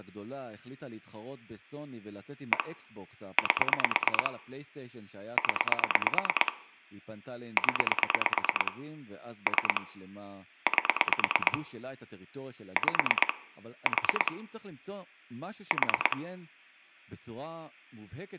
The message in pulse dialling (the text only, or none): 1 8 0 0 3 8 5 4 4